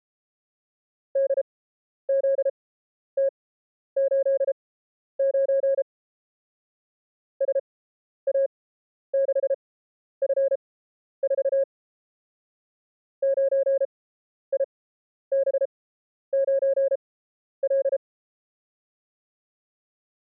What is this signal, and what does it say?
Morse code, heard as a keyed tone, machine-sent, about 33 wpm, spaced as for 11 wpm, 540 Hz. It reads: DZT89 SA6F4 9IB9L